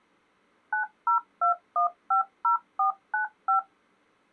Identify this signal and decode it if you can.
DTMF, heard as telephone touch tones, dialled by machine, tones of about 120 ms. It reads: 902150495